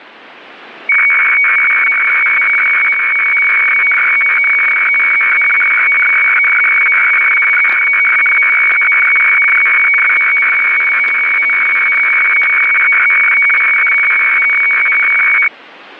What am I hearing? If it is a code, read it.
Weather fax (radiofax), 120 lines a minute, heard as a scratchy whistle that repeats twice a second, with static crashes.